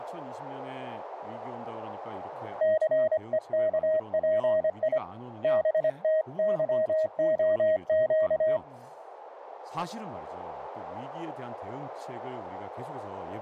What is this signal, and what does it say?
Morse code, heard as a keyed tone, hand-sent with a paddle, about 25 wpm, 630 Hz, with radio static and speech in Korean. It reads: CEKPI BTYOQ